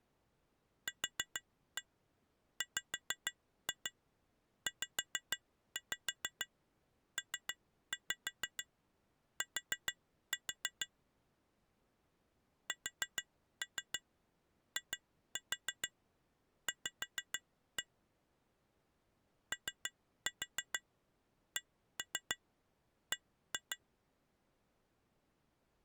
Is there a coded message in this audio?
Yes: tap code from 0.9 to 23.8 s, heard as taps on glass, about 6 knocks a second. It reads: QWZPT SIV OCB